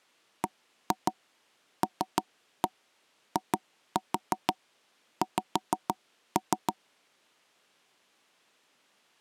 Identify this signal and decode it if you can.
Tap code, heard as taps on a table, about 6 knocks a second. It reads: BLIX